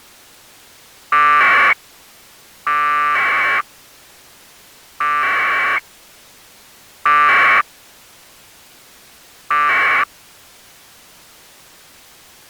Packet radio (AX.25, as in APRS), 1200 baud, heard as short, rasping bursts.